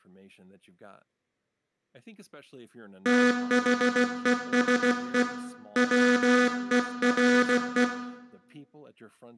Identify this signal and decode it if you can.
Morse code, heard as a buzzer, hand-sent with a paddle, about 16 wpm, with room echo and speech in English. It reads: THESE WERE